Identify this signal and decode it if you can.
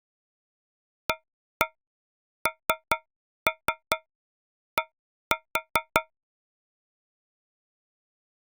Tap code, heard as taps on a metal pipe, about 4 knocks a second. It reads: AND